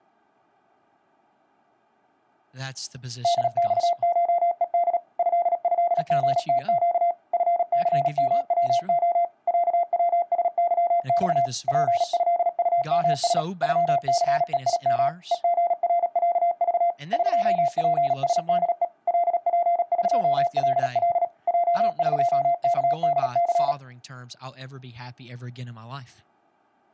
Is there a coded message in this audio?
Yes: Morse code (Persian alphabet) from 3.2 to 23.8 s, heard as a keyed tone, machine-sent, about 37 wpm, 690 Hz, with speech in English. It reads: دخشهد ضضژتگ فثموع صوسظخ پضطمس غثهیم هژرصذ قپسده لپقلل جقکدث